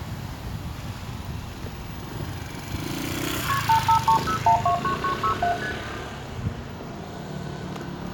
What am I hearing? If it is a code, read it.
Multi-frequency trunk signalling (R1, as on North American trunks), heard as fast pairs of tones, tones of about 100 ms, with room echo and street noise. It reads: KP 8530129967 ST